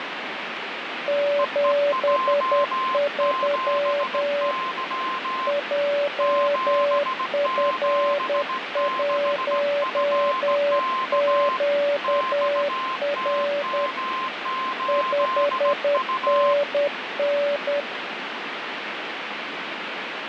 Morse code, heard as two keyed tones, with radio static. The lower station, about 10 wpm, 570 Hz: 73 JF1QR 5NN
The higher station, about 17 wpm, 1040 Hz: EEJ7Y 776FK XTM8U